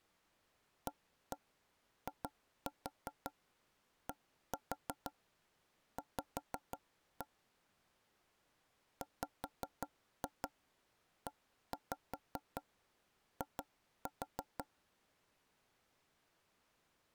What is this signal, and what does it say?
Tap code, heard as knocks on wood, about 5 knocks a second. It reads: AIDV WEI